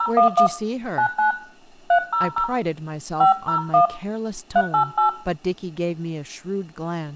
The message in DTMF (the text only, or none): 011 99 300 501 388